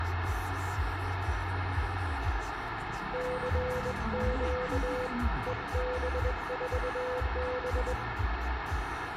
Morse code, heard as a keyed tone, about 21 wpm, 500 Hz, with radio static, room echo and the noise inside a car. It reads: CQ EB4B